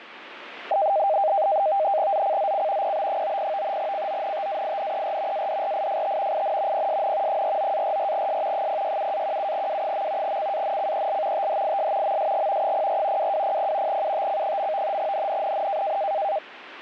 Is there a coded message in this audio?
Yes: NAVTEX (SITOR-B), 100 baud, 170 Hz shift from 0.7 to 16.4 s, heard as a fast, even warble, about 710 Hz centre, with radio static. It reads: ZCZC PB90 CONTAINER ADRIFT IN PSN 49-44S 067-17W. CANCEL THIS MSG 04 2200 UTC. NNNN